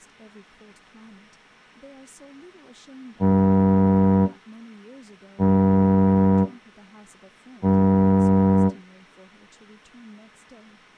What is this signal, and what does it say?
Ship horn signal, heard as a ship's horn, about 100 Hz, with speech in English. 3 short. At sea: I am operating astern propulsion.